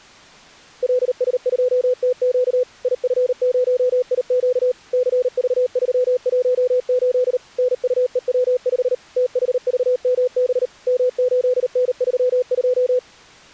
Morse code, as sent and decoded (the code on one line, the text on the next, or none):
.-.. ... ..--- - --.- / .. ..-. ----- .. --.- / -.-. ...- ...-- .---- ---.. / -. ..- . .-- ..... / - .... ...- -- -... / -- ---.. -. ...-- ..---
LS2TQ IF0IQ CV318 NUEW5 THVMB M8N32